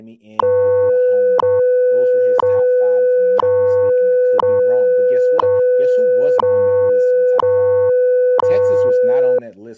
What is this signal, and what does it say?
Radio time signal (WWV, Colorado), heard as ticks, one a second, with speech in English.